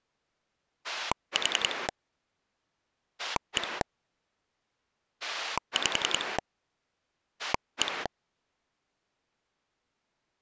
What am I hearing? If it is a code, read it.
Pulse dialling, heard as a rotary dial, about 10 pulses a second. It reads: 4 1 5 1